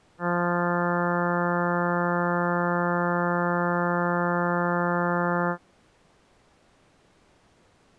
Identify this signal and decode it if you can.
Ship horn signal, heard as a ship's horn, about 180 Hz. 1 long. At sea: a vessel nearing a blind bend, or under power and making way in fog.